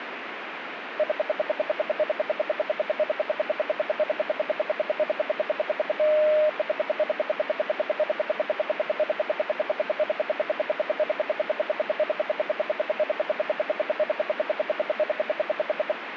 Radio time signal (RWM, Moscow), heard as ten pulses a second, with radio static.